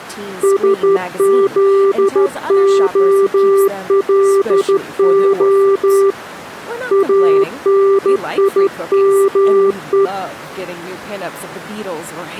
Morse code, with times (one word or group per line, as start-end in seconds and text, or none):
0.4-6.1 SZOLO
6.9-10.1 ANIME